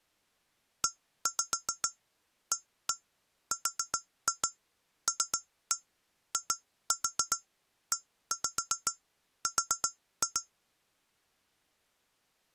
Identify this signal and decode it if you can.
Tap code, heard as taps on glass, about 7 knocks a second. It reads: EARLIER